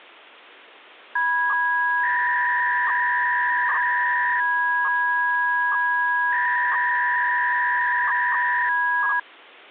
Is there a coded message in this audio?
Yes: 300-baud modem data (V.21 tones) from 1.2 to 9.2 s, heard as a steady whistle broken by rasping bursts, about 300 baud, 200 Hz shift.